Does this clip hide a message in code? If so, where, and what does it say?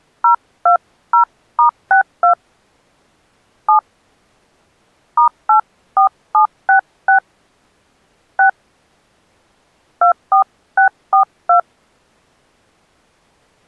Yes: DTMF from 0.2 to 11.6 s, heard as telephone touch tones, dialled by hand, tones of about 110 ms. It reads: 020*62 7 *84766 6 24642